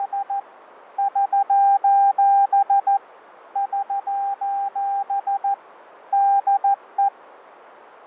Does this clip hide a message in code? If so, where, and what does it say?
Yes: Morse code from 0.0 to 7.1 s, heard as a keyed tone, machine-sent, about 14 wpm, 800 Hz, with fading. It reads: … <SOS> <SOS> DE